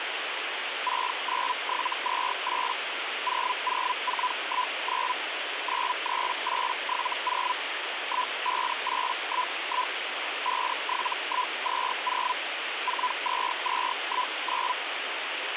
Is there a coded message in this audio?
Yes: Hellschreiber (Feld-Hell, 122.5 baud) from 0.9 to 14.7 s, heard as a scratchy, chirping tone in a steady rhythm, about 1000 Hz, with radio static. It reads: 69728 00419 93870 15811 57120 42219